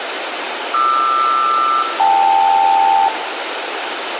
Aircraft SELCAL, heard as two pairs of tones, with radio hiss and room echo. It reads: QR-KL